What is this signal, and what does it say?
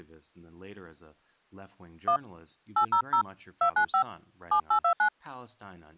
DTMF, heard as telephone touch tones, dialled by hand, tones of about 90 ms, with speech in English. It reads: 1 800 295 7829